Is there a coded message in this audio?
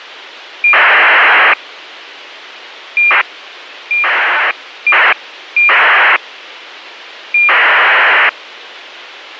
Yes: ACARS aircraft data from 0.6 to 8.3 s, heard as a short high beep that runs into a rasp, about 2400 baud, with radio hiss.